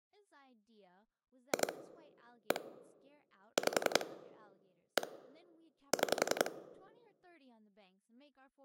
Pulse dialling, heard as clicks on a phone line, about 11 pulses a second, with speech in English. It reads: 2 1 5 1 6